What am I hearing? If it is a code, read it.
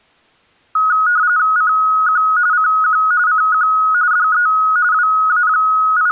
RTTY (45.45 baud, 170 Hz shift), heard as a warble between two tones, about 1360 Hz centre. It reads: CQ CQ CQ DE …